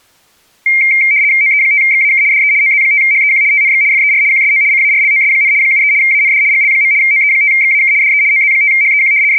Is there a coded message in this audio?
Yes: RTTY (75 baud, 170 Hz shift) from 0.7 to 9.4 s, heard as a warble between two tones, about 2200 Hz centre. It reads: OE5XAK DE OZ5HEQ TNX FER QSO CARLOS, 73 AND GL. OE5XAK DE OZ5HEQ …